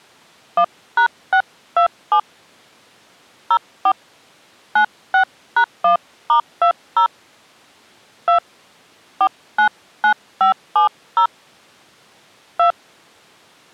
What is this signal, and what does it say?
DTMF, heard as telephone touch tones, dialled by hand, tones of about 90 ms. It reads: 1#627 04 96#1*20 2 499570 2